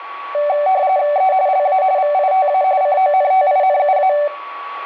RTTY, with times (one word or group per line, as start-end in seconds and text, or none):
1.2-1.3 E
1.5-1.8 LA
2.0-2.6 VITA
2.8-4.1 CONTINUA